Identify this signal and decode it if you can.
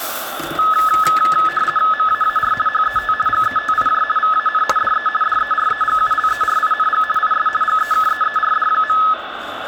RTTY (50 baud, 450 Hz shift), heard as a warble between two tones, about 1500 Hz centre, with radio static and kitchen noise. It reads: MAAR HET GETIJ VAN DE DEREGULERING IS GEKEERD.